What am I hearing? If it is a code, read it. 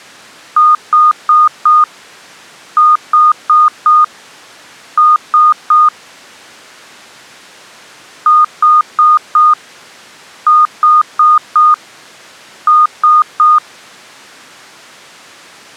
Beep code, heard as beeps, played twice, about 1230 Hz. 4-4-3. In Phoenix BIOS tables: maths coprocessor failure.